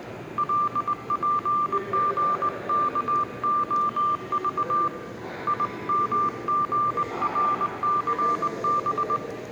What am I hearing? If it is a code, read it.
Morse code, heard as a keyed tone, hand-sent with a straight key, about 20 wpm, 1180 Hz, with room echo and the noise of a subway station. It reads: LPGKOV IMGRCB